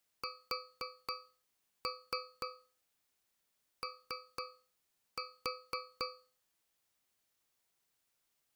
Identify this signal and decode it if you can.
Tap code, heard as taps on a metal pipe, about 4 knocks a second. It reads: SO